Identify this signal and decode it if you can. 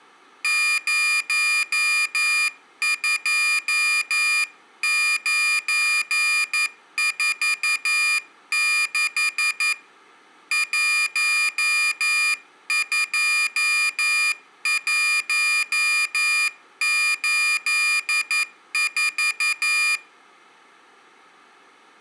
Morse code, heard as a high beeper, hand-sent with a paddle, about 11 wpm, 2400 Hz, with room echo. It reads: 02946 12184